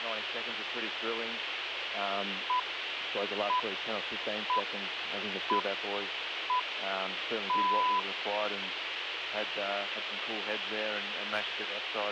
Radio time signal (six pips, as the Greenwich Time Signal), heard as pips, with radio hiss.